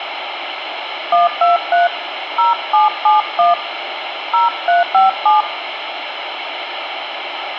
DTMF, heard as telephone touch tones, dialled by hand, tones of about 150 ms, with phone line noise. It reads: 123 0771 0357